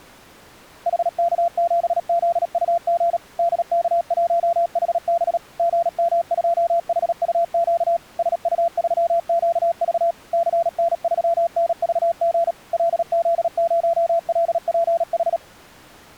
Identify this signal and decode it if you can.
Morse code, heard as a keyed tone, machine-sent, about 37 wpm, 680 Hz. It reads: HK7ZUG DK1HB GM2HUQ SU3QV CN3NVG LZ0LPH